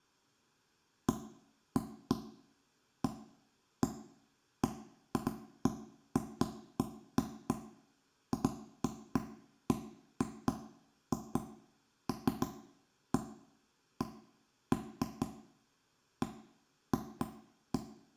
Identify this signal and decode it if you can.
Irregular knocks on wood, with room echo. There is no code.